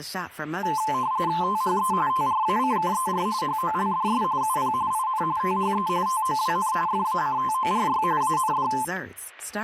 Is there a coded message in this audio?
Yes: RTTY (45.45 baud, 170 Hz shift) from 0.6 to 8.8 s, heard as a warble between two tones, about 960 Hz centre, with static crashes and speech in English. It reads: THE TRACKER HOLDS UP IN THE TOWN FACTORY AND